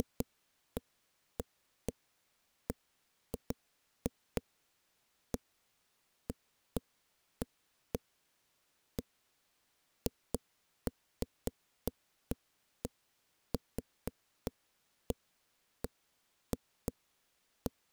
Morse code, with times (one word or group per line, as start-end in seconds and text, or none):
none